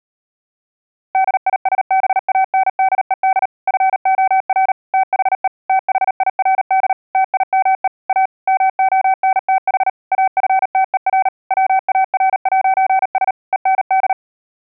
Morse code, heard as a keyed tone, machine-sent, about 38 wpm, 760 Hz. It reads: DISBANDED FOR THE THIRD TIME A MONTH AFTER WAR'S END